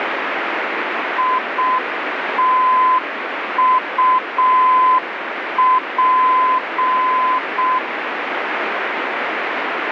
Morse code, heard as a keyed tone, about 6 wpm, 1020 Hz, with radio static. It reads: ITUP